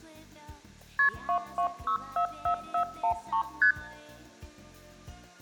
Multi-frequency trunk signalling (R1, as on North American trunks), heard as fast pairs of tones, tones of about 90 ms. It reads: KP 22644413 ST